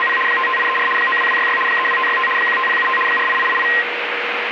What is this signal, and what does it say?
RTTY (75 baud, 850 Hz shift), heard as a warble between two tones, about 1470 Hz centre, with radio static. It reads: … 55834 92266 32565 15075 48888